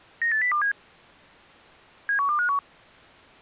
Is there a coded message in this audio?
Yes: five-tone selective call (CCIR) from 0.2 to 2.6 s, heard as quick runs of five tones, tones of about 100 ms. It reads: 98027 71251